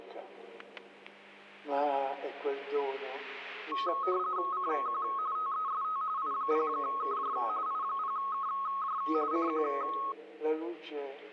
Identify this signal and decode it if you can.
RTTY (45.45 baud, 170 Hz shift), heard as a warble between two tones, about 1180 Hz centre, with static crashes. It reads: CQ TEST I0KJ I0KJ CQ